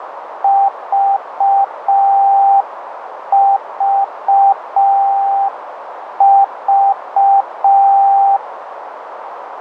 Morse code, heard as a keyed tone, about 5 wpm, 790 Hz, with radio static and a narrow filter. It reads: VVV